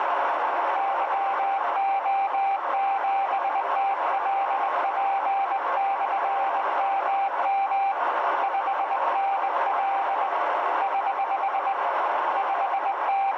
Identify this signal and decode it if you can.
Morse code, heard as a keyed tone, hand-sent with a straight key, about 20 wpm, 790 Hz, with heavy radio static and a narrow filter. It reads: YO7TLP/MM 5NL <HH> …